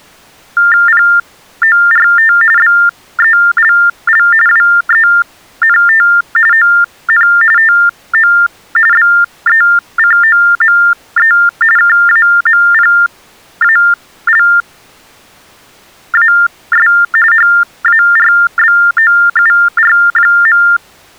TTY/TDD text telephone tones (45.45 baud Baudot), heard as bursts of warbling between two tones, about 400 Hz shift, 1600 Hz centre. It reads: PORT BELL WENT ON TO BECOME KAMPALAS HARBOUR.